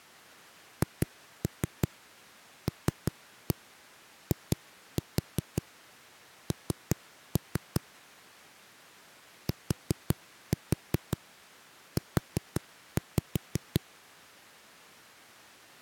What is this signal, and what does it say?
Tap code, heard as knocks on a wall, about 5 knocks a second. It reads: HLIN TU